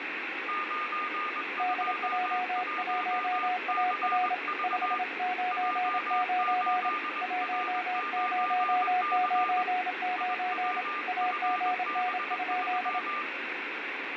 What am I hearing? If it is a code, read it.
Morse code, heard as two keyed tones, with radio static and room echo. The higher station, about 21 wpm, 1200 Hz: 921CV J8R9C IWFB3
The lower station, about 27 wpm, 730 Hz: DJ1AR 599 1099 AGN?